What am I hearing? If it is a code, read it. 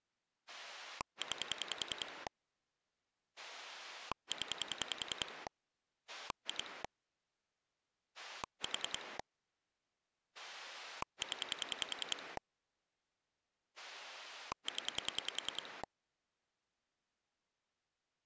Pulse dialling, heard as a rotary dial, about 10 pulses a second. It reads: 9 0 2 4 0 0